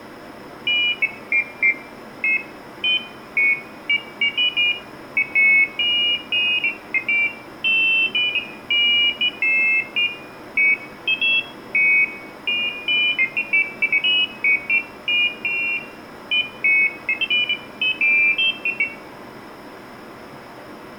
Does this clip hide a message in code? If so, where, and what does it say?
No, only pairs of high tones at irregular times, with room echo.